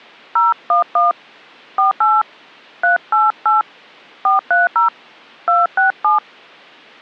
DTMF, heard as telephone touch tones, dialled by hand, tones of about 150 ms. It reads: 011 48 388 430 267